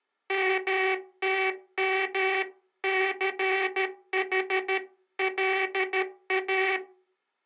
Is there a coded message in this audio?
Yes: Morse code (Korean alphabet) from 0.2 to 6.8 s, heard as a buzzer, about 13 wpm. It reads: 멈추고